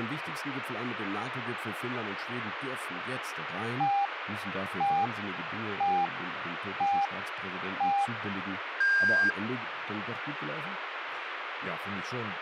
Radio time signal (five pips and a higher one, as on Chinese radio), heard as pips, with radio static and speech in German.